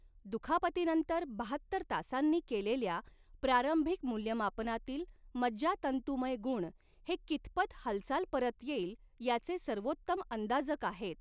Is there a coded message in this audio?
No, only speech in Marathi.